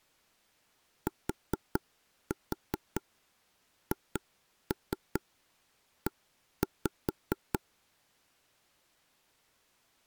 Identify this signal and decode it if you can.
Tap code, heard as taps on a table, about 4 knocks a second. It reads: THE